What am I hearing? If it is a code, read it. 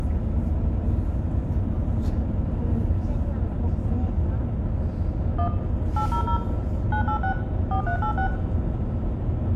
DTMF, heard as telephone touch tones, dialled by machine, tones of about 90 ms, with room echo and the noise inside a bus. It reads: 1 800 986 4386